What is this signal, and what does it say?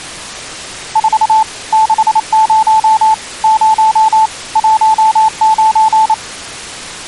Morse code, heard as a keyed tone, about 28 wpm, 880 Hz. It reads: 4 60 0 19